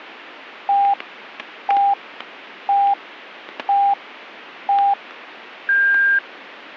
Radio time signal (five pips and a higher one, as on Chinese radio), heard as pips, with static crashes.